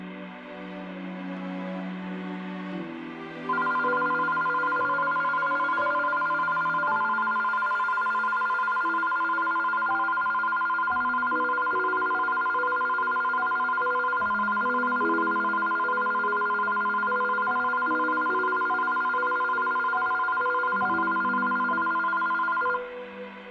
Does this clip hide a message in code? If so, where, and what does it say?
No, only a tone that alternates evenly between two pitches, with room echo.